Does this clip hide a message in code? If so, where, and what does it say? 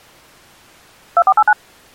Yes: DTMF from 1.2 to 1.5 s, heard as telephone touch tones, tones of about 60 ms. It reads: 2489